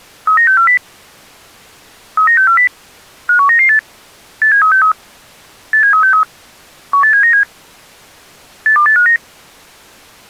Five-tone selective call (CCIR), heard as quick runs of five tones, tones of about 100 ms. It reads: 39640 39640 51998 87363 87363 18797 82859